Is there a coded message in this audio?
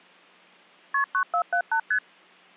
Yes: multi-frequency trunk signalling (R1, as on North American trunks) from 0.9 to 2.0 s, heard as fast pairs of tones, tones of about 80 ms. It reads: KP 9478 ST